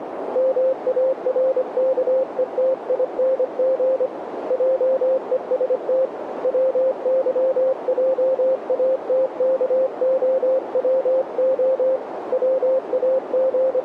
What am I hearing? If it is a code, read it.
Morse code, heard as a keyed tone, hand-sent with a paddle, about 25 wpm, 530 Hz, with radio static and a narrow filter. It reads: MARKETING JEST WYJATKOWO …